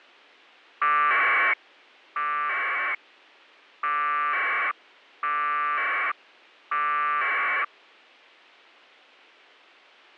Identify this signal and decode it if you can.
Packet radio (AX.25, as in APRS), 1200 baud, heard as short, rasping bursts.